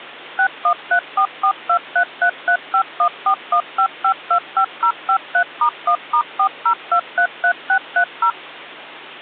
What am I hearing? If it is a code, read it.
DTMF, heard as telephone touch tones, dialled by machine, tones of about 80 ms, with hum. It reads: 61344233351415525053*1*40233630